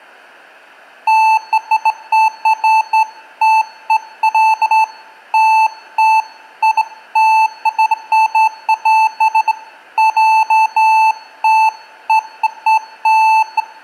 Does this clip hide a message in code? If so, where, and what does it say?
No, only beeps of irregular length, with room echo.